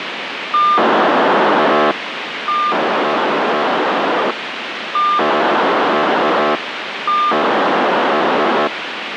POCSAG pager data (2400 baud), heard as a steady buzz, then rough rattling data, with radio hiss.